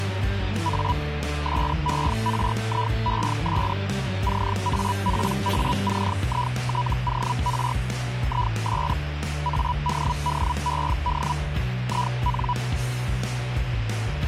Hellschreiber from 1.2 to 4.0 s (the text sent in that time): SERIES